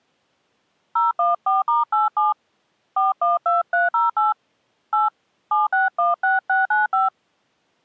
DTMF, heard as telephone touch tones, dialled by hand, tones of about 160 ms. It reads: 014*87 412308 8 7616695